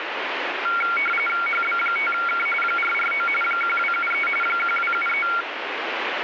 RTTY (45.45 baud, 850 Hz shift), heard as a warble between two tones, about 1800 Hz centre, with radio static. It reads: HB5K 449 1273 1273